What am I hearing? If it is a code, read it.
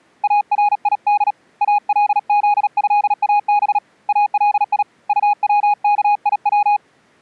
Morse code (Arabic alphabet), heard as a keyed tone, hand-sent with a paddle, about 37 wpm, 830 Hz. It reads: اريد الذهاب الي طوكيو